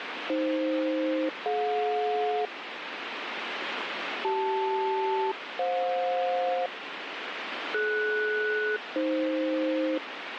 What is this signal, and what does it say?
Aircraft SELCAL, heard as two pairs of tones, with radio static. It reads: AF-DJ CL-FJ DS-AF